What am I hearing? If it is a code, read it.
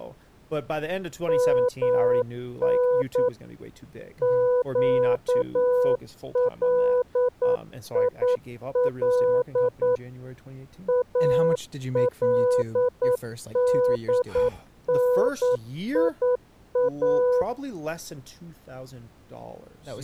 Morse code (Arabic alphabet), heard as a keyed tone, machine-sent, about 9 wpm, 500 Hz, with speech in English. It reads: من قليل الدنيا